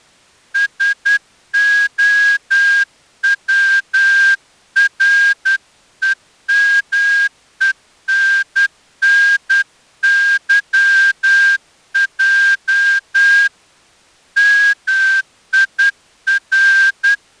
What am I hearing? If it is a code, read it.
Morse code (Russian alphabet), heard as a whistle, hand-sent with a straight key, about 10 wpm. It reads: СОВРЕМЕННЫЙ МИР